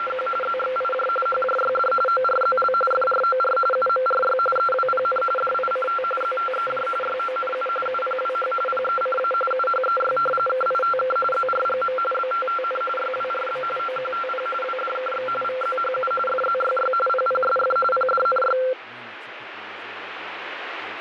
RTTY (45.45 baud, 850 Hz shift), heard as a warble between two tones, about 940 Hz centre, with radio static and speech in English. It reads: … ZXIJ HJYD ORZL FROR UMRY EWPN DICT ZTEJ YONU UPWH PECA UHEY KITK ZRGM BTTN YWRB OQTP WDKX VZHU FZYY PPSF PDNY